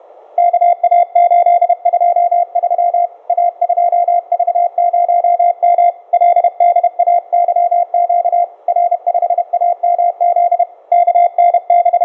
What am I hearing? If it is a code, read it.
Morse code, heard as a keyed tone, hand-sent with a paddle, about 31 wpm, 700 Hz. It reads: KA823 A2V0M LDAYQ R5AMZ …